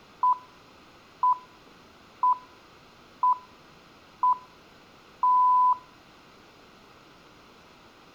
Radio time signal (six pips, as the Greenwich Time Signal), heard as pips, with room echo.